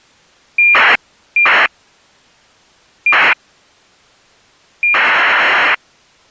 ACARS aircraft data, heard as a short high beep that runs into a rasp, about 2400 baud.